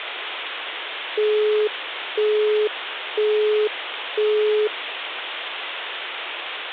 Telephone call progress tone (single-tone plan, as in Europe, Japan and elsewhere), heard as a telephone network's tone, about 420 Hz, 0.5 s on and 0.5 s off, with phone line noise. Busy tone.